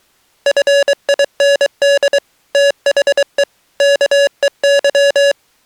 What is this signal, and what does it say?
Morse code, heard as electronic beeps, machine-sent, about 23 wpm, 560 Hz. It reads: FIND THE KEY